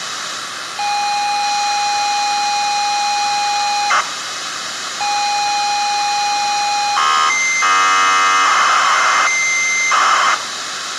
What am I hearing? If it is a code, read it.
ZX Spectrum tape loading, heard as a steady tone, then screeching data, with tape hiss and room echo.